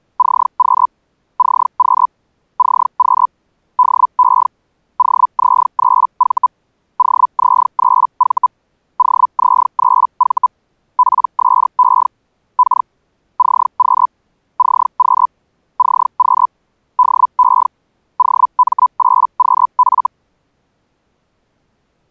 Hellschreiber (Feld-Hell, 122.5 baud), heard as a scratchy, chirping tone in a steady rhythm, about 1000 Hz. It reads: CQ CQ CQ DE OZ3V OZ3V OZ3V PSE K CQ CQ CQ DE OM8QF